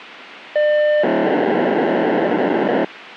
POCSAG pager data (1200 baud), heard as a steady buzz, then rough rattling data, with radio hiss.